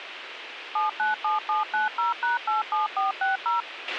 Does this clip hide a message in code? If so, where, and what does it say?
Yes: DTMF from 0.8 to 3.6 s, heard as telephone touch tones, dialled by machine, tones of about 150 ms, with radio hiss and a squelch burst at the end. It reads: 797790#87460